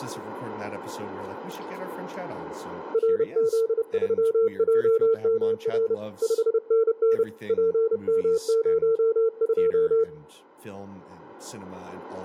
Morse code, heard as a keyed tone, hand-sent with a paddle, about 30 wpm, 450 Hz, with speech in English. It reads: RZ3JMR 5NN PM02